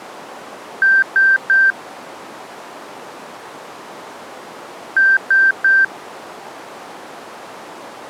Beep code, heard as beeps, played twice, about 1550 Hz. 3 short. In AMI BIOS tables: failure in the first 64 KB of memory; in Dell tables: chipset error.